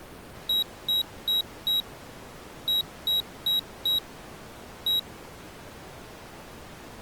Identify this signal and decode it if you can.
Beep code, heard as a piezo beeper, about 3850 Hz. 4-4-1. In Phoenix BIOS tables: serial port failure.